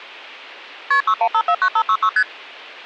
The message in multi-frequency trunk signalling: KP 61549566 ST

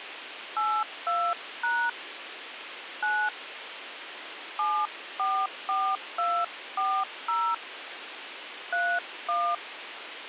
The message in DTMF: 82# 9 744240 31

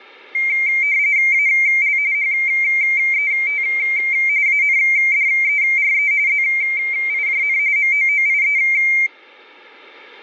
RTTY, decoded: AL HET ANDERE ZIJN MOOIE

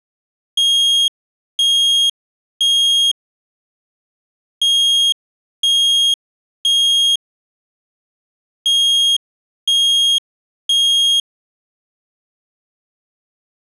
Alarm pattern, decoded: temporal three

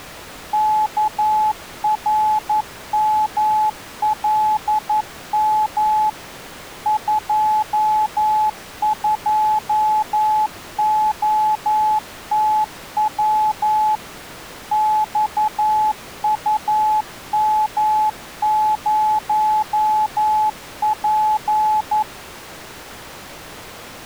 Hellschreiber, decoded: none

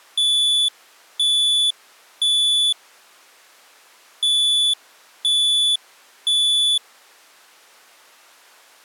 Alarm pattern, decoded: temporal three

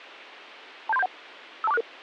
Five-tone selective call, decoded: 27371 52466

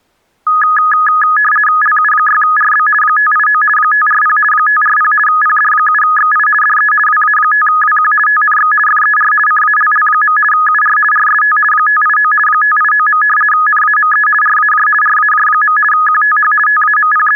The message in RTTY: LU6RB 589 540 540 PD7XI DE WA5WQ TNX FER CALL. UR RST 589 589. NAME RAJ RAJ. QTH …

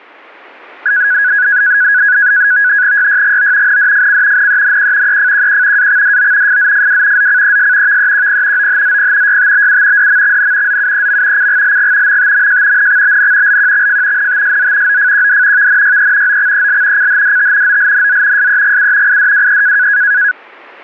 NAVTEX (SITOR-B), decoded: YYGO NDFC NENQ EFQQ AXDO FZFW ZCES VEQP OHZP YTBU DMXN ZUEM CGLG MTMJ NXBN LQXF NTSZ OFQD VNYE OXEL CHDT OLNZ SEGU IDWE

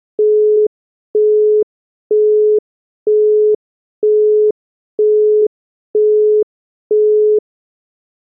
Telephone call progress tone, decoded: busy tone

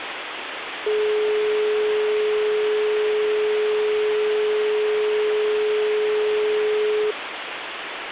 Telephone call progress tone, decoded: dial tone

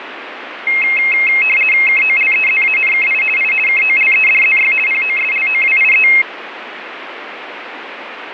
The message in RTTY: KOLEZANKI I KOLEDZY POSLOWIE

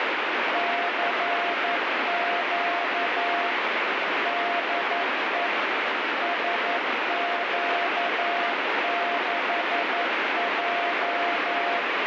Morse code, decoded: CQ DE SQ6J

